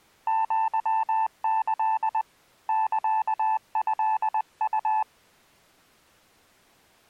Morse code (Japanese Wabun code), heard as a keyed tone, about 20 wpm, 880 Hz. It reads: アキ サトウ